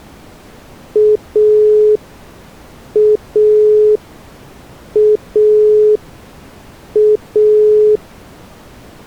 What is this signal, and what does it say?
Telephone call progress tone (pulsed, as in Italy), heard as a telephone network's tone, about 420 Hz. Dial tone.